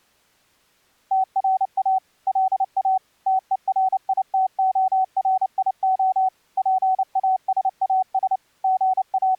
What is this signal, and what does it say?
Morse code, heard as a keyed tone, machine-sent, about 29 wpm, 750 Hz. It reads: TRA LA TERITORIO PASAS …